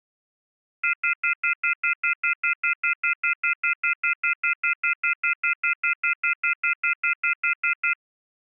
Telephone call progress tone (North American plan), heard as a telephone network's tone, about 1400, 2050, 2450, 2600 Hz, 0.1 s on and 0.1 s off. Off-hook warning tone.